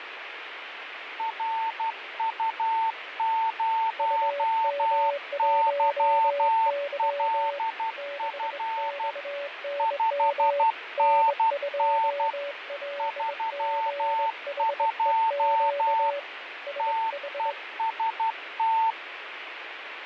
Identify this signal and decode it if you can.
Morse code, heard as two keyed tones, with radio static and fading. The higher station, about 12 wpm, 900 Hz: RU0YLF 5NN 32 TEST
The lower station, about 22 wpm, 570 Hz: UM1Y 6XNM N2LGHEQ SH